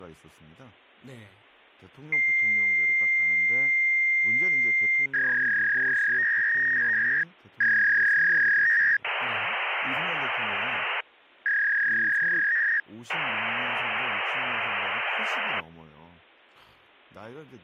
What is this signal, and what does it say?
Fax machine handshake, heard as a long tone, a warble and hiss, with speech in Korean.